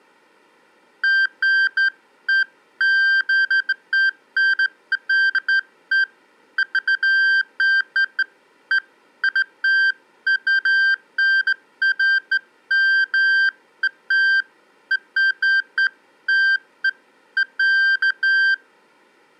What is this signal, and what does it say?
Beeps of irregular length. There is no code.